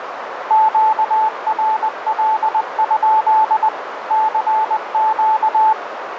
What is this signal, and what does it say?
Morse code, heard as a keyed tone, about 20 wpm, 870 Hz, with radio static and a narrow filter. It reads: QRL? CQ